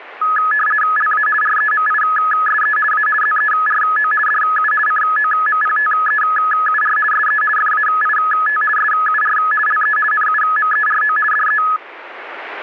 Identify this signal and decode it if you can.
RTTY (50 baud, 450 Hz shift), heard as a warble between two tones, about 1490 Hz centre. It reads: LA REMISE A ZERO DU COMPTEUR SE FAIT SUR LE NUMERO DE